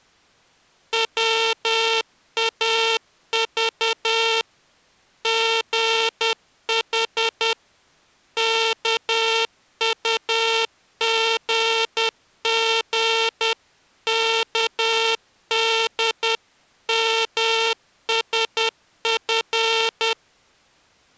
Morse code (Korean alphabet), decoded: 볼 수 있으면

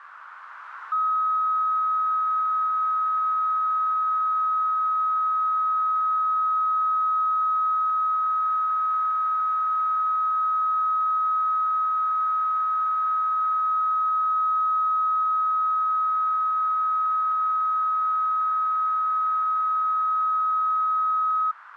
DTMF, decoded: none

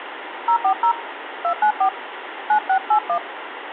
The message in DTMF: 040 294 9681

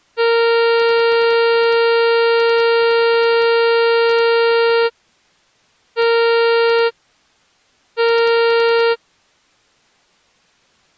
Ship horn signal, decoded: 1 long, 2 short

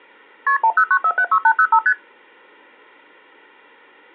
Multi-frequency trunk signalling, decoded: KP 109476805 ST

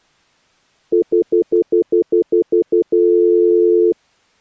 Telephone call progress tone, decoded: stutter dial tone

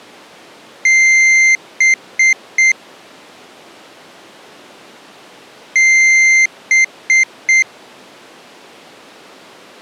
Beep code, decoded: 1 long, 3 short

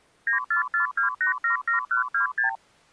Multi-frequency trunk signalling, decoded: 9442877126

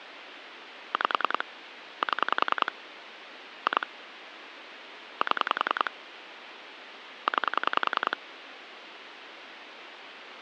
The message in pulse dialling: 5 7 2 7 9

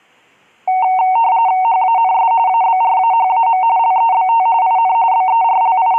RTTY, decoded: HANS ABRAHAM LEBT IN …

